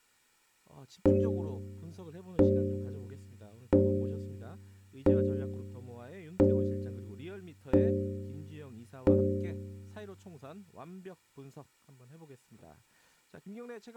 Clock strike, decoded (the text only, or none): 7